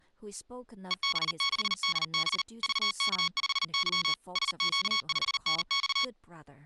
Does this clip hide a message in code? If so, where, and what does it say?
Yes: Morse code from 0.8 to 6.1 s, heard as electronic beeps, machine-sent, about 39 wpm, 1110 Hz, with speech in English. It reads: EB6DB VK5Y SQ5NX